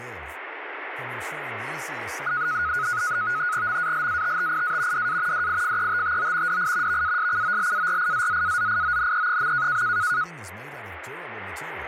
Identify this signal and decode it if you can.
NAVTEX (SITOR-B), 100 baud, 170 Hz shift, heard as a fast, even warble, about 1360 Hz centre, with radio static and speech in Swedish. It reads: MALATTIA DA DIFETTO DI VASCOLARIZZAZIONE.